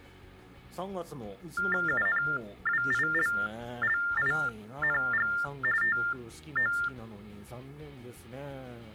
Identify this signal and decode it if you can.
TTY/TDD text telephone tones (45.45 baud Baudot), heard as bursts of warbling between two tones, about 400 Hz shift, 1600 Hz centre. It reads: UNWILLING TO